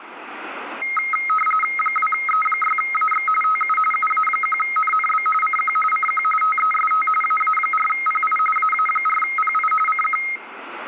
RTTY (45.45 baud, 850 Hz shift), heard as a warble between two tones, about 1700 Hz centre. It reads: 2E6AX TU UA1NNB CQ CQ TEST AA4PI AA4PI CQ